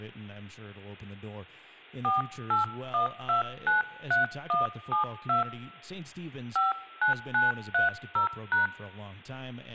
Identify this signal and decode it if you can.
DTMF, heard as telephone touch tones, dialled by hand, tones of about 140 ms, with speech in English. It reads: 481293172 59930#